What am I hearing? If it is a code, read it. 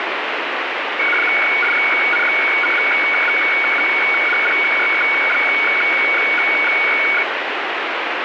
Weather fax (radiofax), 120 lines a minute, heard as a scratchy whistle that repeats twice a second, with heavy radio static.